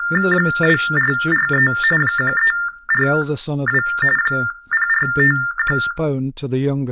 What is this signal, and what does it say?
TTY/TDD text telephone tones (45.45 baud Baudot), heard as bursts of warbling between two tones, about 400 Hz shift, 1600 Hz centre, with speech in English. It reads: 2443 1342 0451